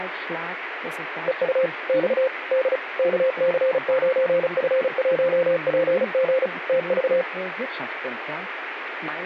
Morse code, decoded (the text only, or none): EU X D KC9F1PG TV